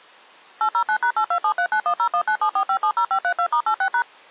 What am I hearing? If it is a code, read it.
DTMF, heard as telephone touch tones, dialled by machine, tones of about 80 ms. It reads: 809#82739101974570532*86#